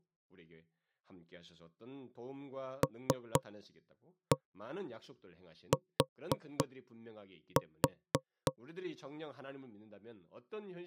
Tap code, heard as knocks on wood, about 3 knocks a second, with speech in Korean. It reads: LT